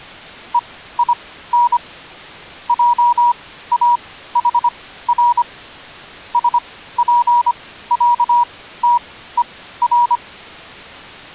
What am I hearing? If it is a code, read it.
Morse code (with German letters), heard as a keyed tone, machine-sent, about 25 wpm, spaced as for 15 wpm, 960 Hz. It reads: EIN JAHR SPÄTER